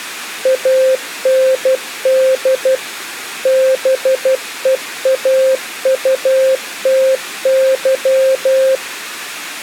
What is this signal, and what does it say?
Morse code, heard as a keyed tone, machine-sent, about 12 wpm, 530 Hz. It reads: AND BEAUTY